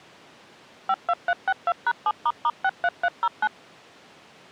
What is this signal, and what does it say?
DTMF, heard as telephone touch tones, dialled by machine, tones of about 50 ms. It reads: 52362#7**63309